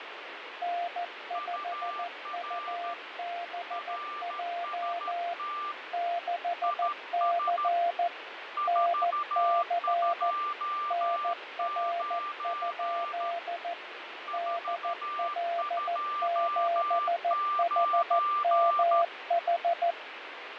Morse code, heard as two keyed tones, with radio static and fading. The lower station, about 14 wpm, 690 Hz: N5UBJ 6C NC NR? DL7HMH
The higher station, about 13 wpm, 1180 Hz: UR RST IS 429 429